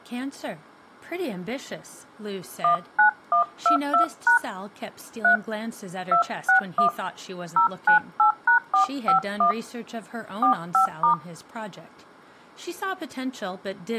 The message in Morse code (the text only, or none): none